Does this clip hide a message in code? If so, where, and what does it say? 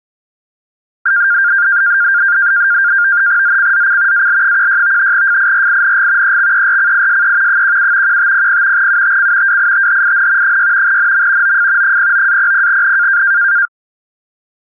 Yes: NAVTEX (SITOR-B), 100 baud, 170 Hz shift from 1.1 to 13.7 s, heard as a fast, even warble, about 1500 Hz centre. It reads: ZCZC AL16 FIRING EXERCISE 17 1500 UTC WITHIN 6 NM OF 09-00N